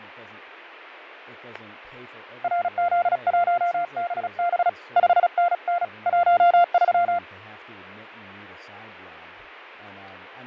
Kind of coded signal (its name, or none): Morse code